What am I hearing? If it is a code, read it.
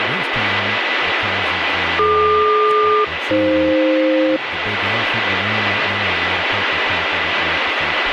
Aircraft SELCAL, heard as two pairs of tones, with radio static and speech in English. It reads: DQ-AF